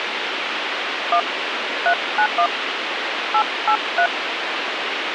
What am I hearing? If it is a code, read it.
DTMF, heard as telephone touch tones, dialled by hand, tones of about 80 ms, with radio hiss. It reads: 1 391 883